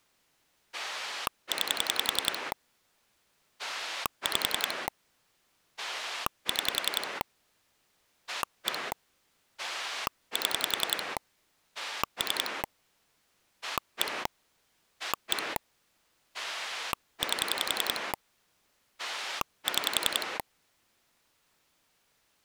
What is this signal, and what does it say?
Pulse dialling, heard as a rotary dial, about 10 pulses a second. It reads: 9 5 6 1 7 3 1 1 8 6